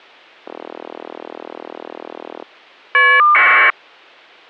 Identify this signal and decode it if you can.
Caller ID data burst, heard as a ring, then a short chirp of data, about 1200 baud.